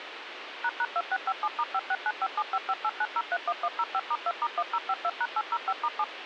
DTMF, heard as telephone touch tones, dialled by machine, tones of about 50 ms, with radio hiss. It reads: ##2657*569575589031105*2*1052#805*7